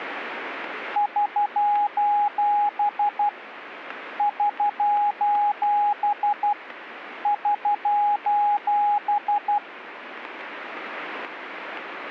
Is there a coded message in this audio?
Yes: Morse code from 0.9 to 9.6 s, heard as a keyed tone, hand-sent with a paddle, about 12 wpm, 830 Hz. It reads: <SOS> <SOS> <SOS>